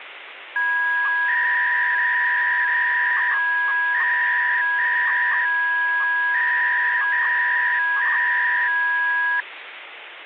300-baud modem data (V.21 tones), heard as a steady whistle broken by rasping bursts, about 300 baud, 200 Hz shift, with phone line noise.